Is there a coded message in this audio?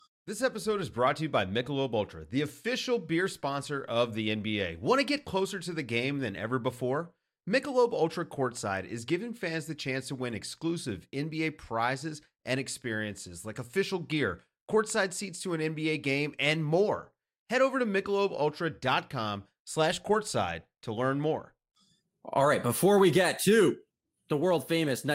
No, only speech in English.